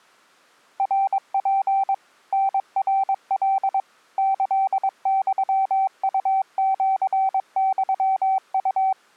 Morse code (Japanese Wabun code), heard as a keyed tone, machine-sent, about 22 wpm, 770 Hz. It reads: ナツ タナカ キユウシユウ